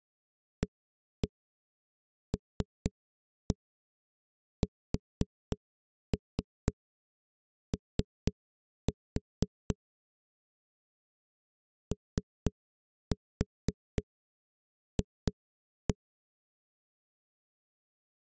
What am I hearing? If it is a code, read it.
Tap code, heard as knocks on a wall, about 4 knocks a second. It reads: ALSO OF